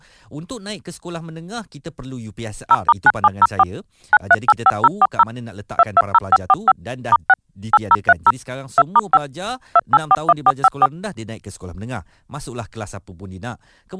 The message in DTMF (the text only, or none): 0*9704 9385040 220545 *6 8030 2*5 2841454